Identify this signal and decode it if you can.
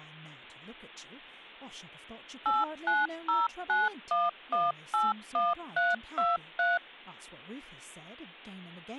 DTMF, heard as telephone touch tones, dialled by machine, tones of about 190 ms, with speech in English. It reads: 89091181323